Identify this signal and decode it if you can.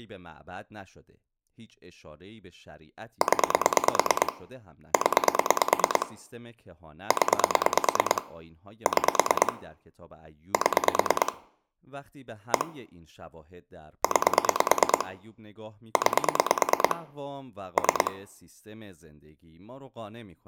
Pulse dialling, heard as clicks on a phone line, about 9 pulses a second, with room echo and speech in Persian. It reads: 0 0 0 6 7 1 9 9 3